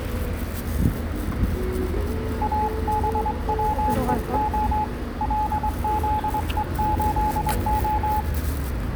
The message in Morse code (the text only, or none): ABWEO LZE8O